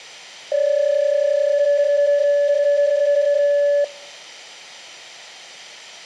PSK31 (31.25 baud), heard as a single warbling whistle, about 580 Hz.